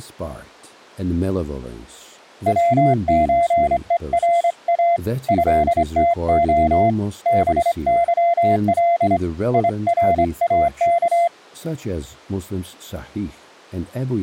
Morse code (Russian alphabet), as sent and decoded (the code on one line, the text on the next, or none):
.-- ---. . .-. .- / ..-.. - --- / -... -.-- .-.. / .. .-. .- -.-
ВЧЕРА ЭТО БЫЛ ИРАК